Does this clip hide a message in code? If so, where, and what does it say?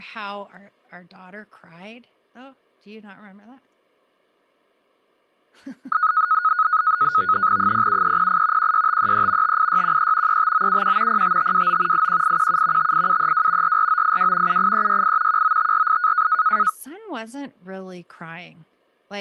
Yes: NAVTEX (SITOR-B), 100 baud, 170 Hz shift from 5.9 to 16.7 s, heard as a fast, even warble, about 1360 Hz centre, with speech in English. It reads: 07308 16533 58613 35971 05529 81817 58732 44982 78368 19548